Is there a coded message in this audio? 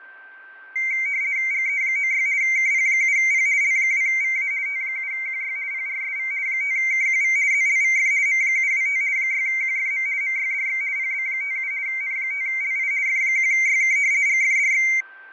Yes: RTTY (50 baud, 170 Hz shift) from 0.8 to 15.0 s, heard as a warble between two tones, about 2200 Hz centre, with fading and a steady whistle near 1560 Hz. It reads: GE96 KP7P L2VA T7QY PRSV 5KQV ZLVF M725 6QFM MYDX PB57 N5LI F1YK GFDX